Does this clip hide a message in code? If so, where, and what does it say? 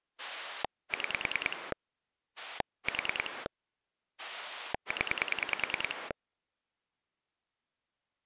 Yes: pulse dialling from 0.2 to 6.1 s, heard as a rotary dial, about 10 pulses a second. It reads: 6 4 0